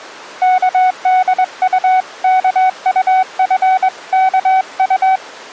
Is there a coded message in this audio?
Yes: Morse code (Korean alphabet) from 0.4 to 5.2 s, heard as a keyed tone, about 22 wpm, 750 Hz. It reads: 의인이